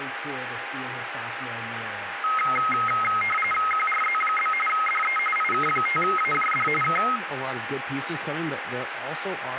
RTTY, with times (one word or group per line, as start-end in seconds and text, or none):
3.7-4.5 QRZ?
4.7-5.2 DE
5.4-6.7 IK5AJD
6.8-7.0 K